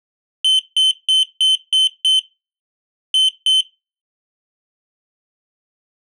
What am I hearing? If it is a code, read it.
Beep code, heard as a piezo beeper, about 3050 Hz. 6-2.